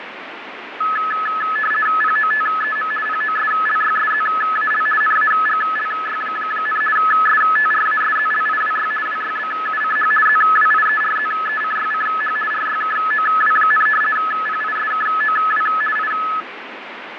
RTTY (50 baud, 450 Hz shift), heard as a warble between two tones, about 1500 Hz centre, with radio static and fading. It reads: POTEM POSLYSZAL NAGLY, STRASZLIWY WYBUCH ZWIERZECYCH RYKOW, PISKOW I